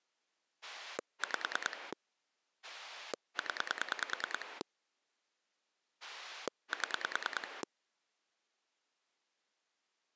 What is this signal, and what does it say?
Pulse dialling, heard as a rotary dial, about 9 pulses a second. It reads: 5 0 7